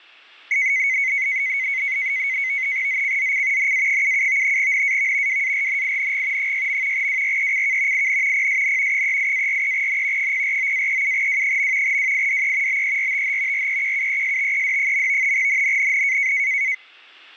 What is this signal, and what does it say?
NAVTEX (SITOR-B), 100 baud, 170 Hz shift, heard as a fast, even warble, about 2150 Hz centre. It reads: ZCZC NA77 NAV WARNING 6. WRECK IN PSN 38-43N 049-37W. WIDE BERTH REQUESTED. NNNN